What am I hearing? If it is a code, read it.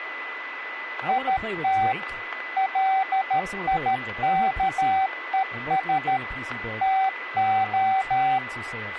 Morse code, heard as a keyed tone, machine-sent, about 13 wpm, 770 Hz, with radio static, a steady whistle near 2000 Hz and speech in English. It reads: IT LIKES TO